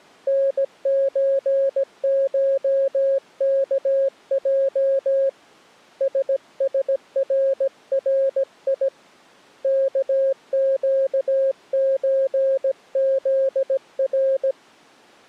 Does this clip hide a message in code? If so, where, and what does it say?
Yes: Morse code (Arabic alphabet) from 0.2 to 14.6 s, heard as a keyed tone, hand-sent with a paddle, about 17 wpm, 540 Hz. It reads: نزشكج سسرري كقزذر